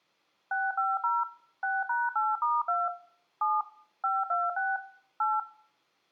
DTMF, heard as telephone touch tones, dialled by machine, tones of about 200 ms, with room echo. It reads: 650 6#8*2 7 526 8